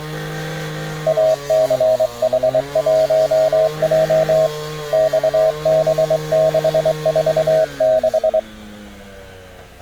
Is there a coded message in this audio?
Yes: Morse code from 1.0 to 8.5 s, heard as a keyed tone, hand-sent with a straight key, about 23 wpm, 640 Hz, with street noise. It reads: ACH1J XB646